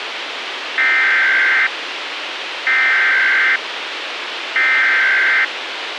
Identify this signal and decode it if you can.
Emergency Alert System (SAME) tones (header bursts), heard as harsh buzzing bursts, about 520.83 baud, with radio hiss and a squelch burst at the end.